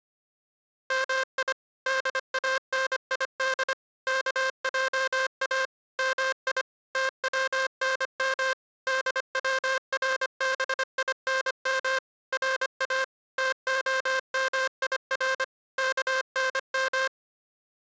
Morse code (Persian alphabet), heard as a buzzer, machine-sent, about 25 wpm. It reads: می دانید کجا می تونم دوربینم را تعمیر کنم